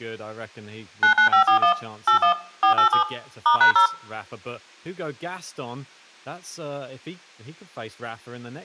DTMF, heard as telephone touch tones, dialled by machine, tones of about 100 ms, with room echo and speech in English. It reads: 99541 81 487 *#0